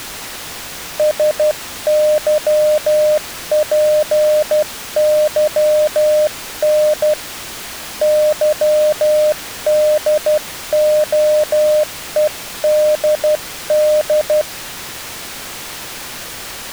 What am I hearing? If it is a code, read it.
Morse code, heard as a keyed tone, hand-sent with a paddle, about 12 wpm, 610 Hz. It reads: SYPYN YDOEDD